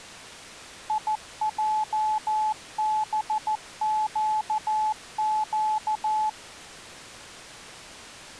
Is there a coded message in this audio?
Yes: Morse code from 0.8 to 6.4 s, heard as a keyed tone, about 14 wpm, 860 Hz. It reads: IJBQQ